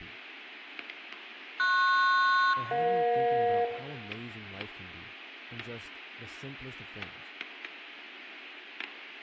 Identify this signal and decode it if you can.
Aircraft SELCAL, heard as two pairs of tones, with static crashes, room echo and speech in English. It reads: PS-EJ